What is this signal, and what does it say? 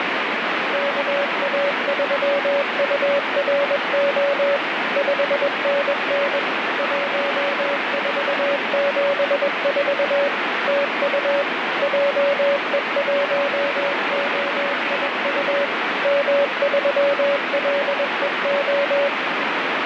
Morse code, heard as a keyed tone, machine-sent, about 21 wpm, 560 Hz, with heavy radio static. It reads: KA3URO 5NN 1474 TU JE1OIU M3LEO